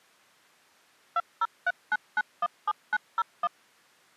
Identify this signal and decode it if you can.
DTMF, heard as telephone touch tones, dialled by machine, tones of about 40 ms. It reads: 2039917901